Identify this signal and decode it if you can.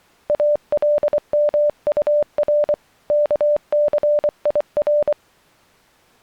Morse code (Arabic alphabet), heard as a keyed tone, hand-sent with a paddle, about 24 wpm, 590 Hz. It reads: المطر كثير